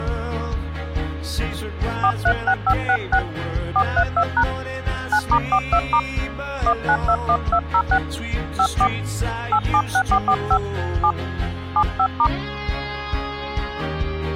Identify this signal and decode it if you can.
DTMF, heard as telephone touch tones, dialled by hand, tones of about 70 ms. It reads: 436566 432# 9*42* 1921206 54 876445 7 75*